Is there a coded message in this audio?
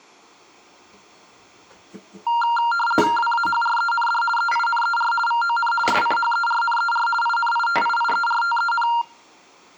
Yes: RTTY (50 baud, 450 Hz shift) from 2.3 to 9.0 s, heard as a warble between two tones, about 1160 Hz centre, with kitchen noise. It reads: WAHREND EINER VON SCHERNER INITIIERTEN